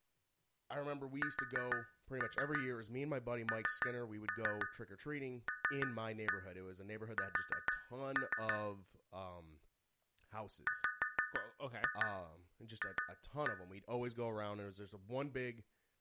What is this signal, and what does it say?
Tap code, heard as taps on a metal pipe, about 6 knocks a second, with speech in English. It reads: SNLS WF